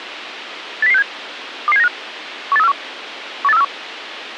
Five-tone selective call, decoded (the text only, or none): 80067 22795 18341 18341